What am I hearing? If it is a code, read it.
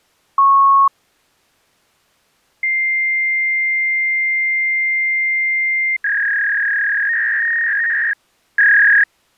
Fax machine handshake, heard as a beep, a long tone and a warble.